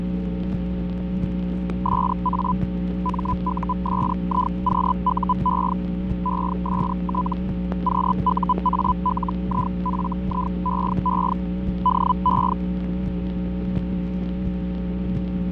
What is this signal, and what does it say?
Hellschreiber (Feld-Hell, 122.5 baud), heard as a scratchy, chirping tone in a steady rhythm, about 1000 Hz, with fading. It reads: SA MUSIQUE EST QUALIFIEE DE